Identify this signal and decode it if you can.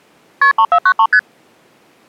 Multi-frequency trunk signalling (R1, as on North American trunks), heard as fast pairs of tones, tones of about 70 ms. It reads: KP 3493 ST